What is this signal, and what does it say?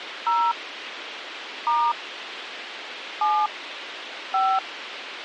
DTMF, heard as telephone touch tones, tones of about 250 ms, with radio hiss. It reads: 0 * 7 5